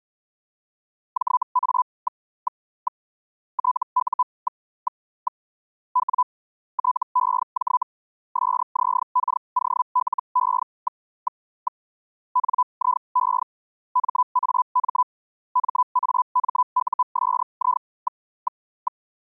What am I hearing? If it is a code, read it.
Hellschreiber (Feld-Hell, 122.5 baud), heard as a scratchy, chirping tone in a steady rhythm, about 1000 Hz. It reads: JA... TU... W TEJ SZKOLE... NIE MAM MAMUSI...